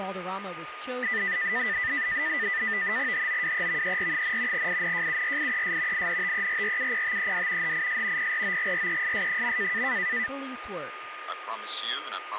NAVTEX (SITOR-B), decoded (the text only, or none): HOWEVER, INJURIES INTERRUPTED HIS PROGRESS.